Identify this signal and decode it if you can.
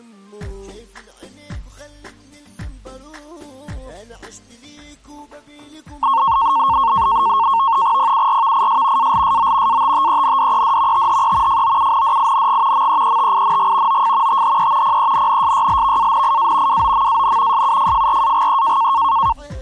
NAVTEX (SITOR-B), 100 baud, 170 Hz shift, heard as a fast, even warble, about 1000 Hz centre. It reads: PURVIS ALSO ATTENDED THE FOUNDING MEETING OF THE PENNSYLVANIA WOMAN SUFFRAGE